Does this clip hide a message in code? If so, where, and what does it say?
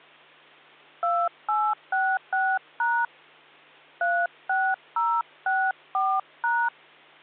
Yes: DTMF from 1.0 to 6.7 s, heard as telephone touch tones, dialled by hand, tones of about 250 ms, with hum. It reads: 2866# 36064#